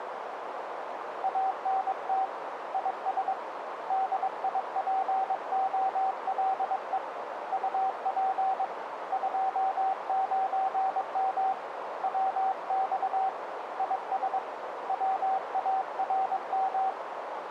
Morse code, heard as a keyed tone, hand-sent with a paddle, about 22 wpm, 770 Hz, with radio static and a narrow filter. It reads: ANT IS DIPOLE UP 29M WX IS WARM